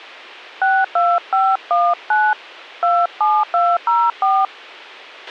DTMF, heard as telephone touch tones, dialled by hand, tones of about 230 ms, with a squelch burst at the end. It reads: 62519 27204